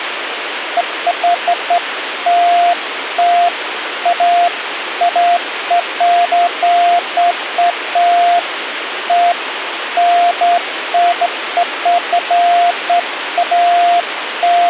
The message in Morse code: none

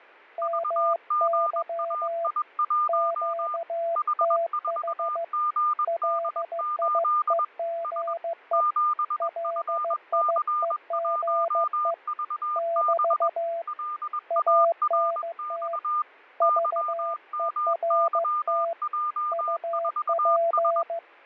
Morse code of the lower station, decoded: MY QTH LIEGE LIEGE <BT> ANT VERT UP

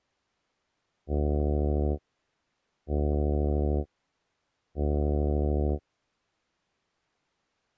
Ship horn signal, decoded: 3 short

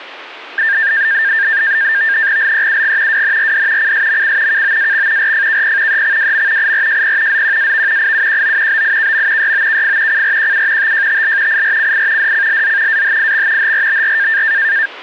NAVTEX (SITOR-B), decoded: LEUG WNRD CSMC KOAX RFKP EXWM IRJP ZQAV IUQO BIKM YOKF CRQU TJTL IRCI DCLZ AHIX HRBR

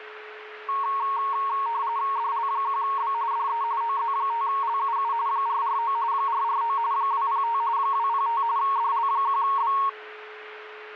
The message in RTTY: DL1B DE OZ5LUU 449 449 205 205 DL1B

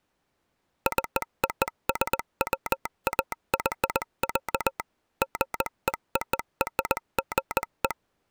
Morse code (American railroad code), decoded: COSWAY, GEORGE

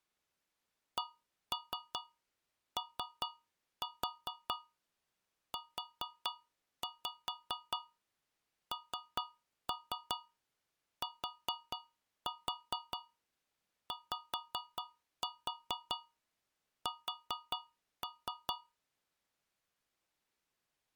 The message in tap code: COUNTYS

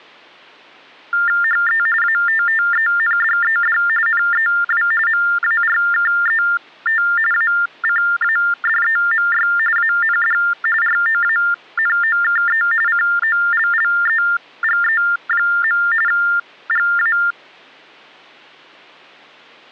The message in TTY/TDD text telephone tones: HE ATTENDED NEW MARKET ACADEMY AND ROANOKE COLLEGE. GA

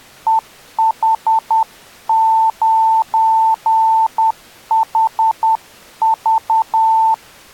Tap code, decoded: none

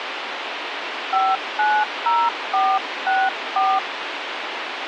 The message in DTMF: 590464

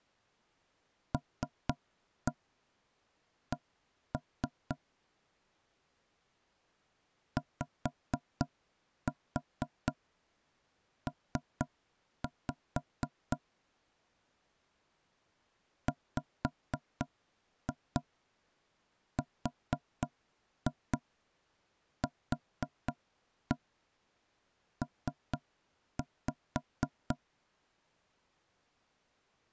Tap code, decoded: LC YP WRQP

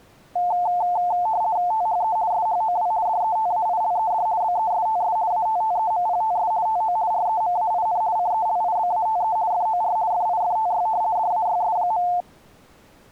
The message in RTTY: THE SHOW DETAILED BESTS ATTEMPTS TO REMAIN CELIBATE FOR FIFTY DAYS.

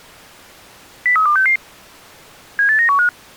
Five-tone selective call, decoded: 03266 78915

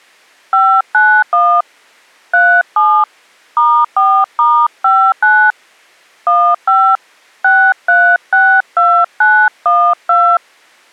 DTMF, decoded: 591 37 *4*59 15 6362912

